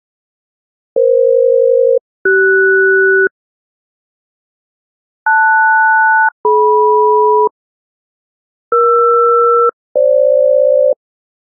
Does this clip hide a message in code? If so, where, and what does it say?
Yes: aircraft SELCAL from 1.0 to 10.9 s, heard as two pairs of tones. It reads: EF-CS LS-DM ER-FG